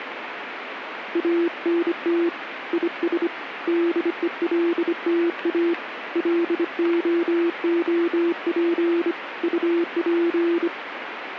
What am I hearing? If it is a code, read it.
Morse code, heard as a keyed tone, hand-sent with a bug key, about 25 wpm, 340 Hz, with radio static. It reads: ANT IS DELTA LOOP UP